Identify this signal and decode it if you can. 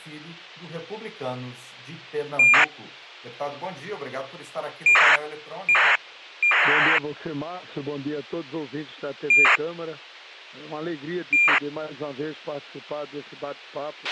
ACARS aircraft data, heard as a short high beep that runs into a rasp, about 2400 baud, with a squelch burst at the end.